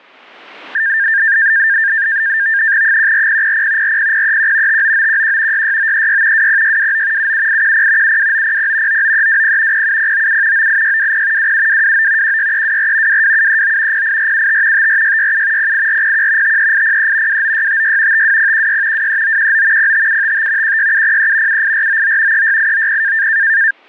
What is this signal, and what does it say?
NAVTEX (SITOR-B), 100 baud, 170 Hz shift, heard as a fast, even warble, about 1700 Hz centre, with static crashes. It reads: 14000 40031 59911 66936 20629 77810 72900 99320 07097 98620 27229 16324 22739 08475 54667 08401 53803 29656 52016 23919 05755 16703 78499 36890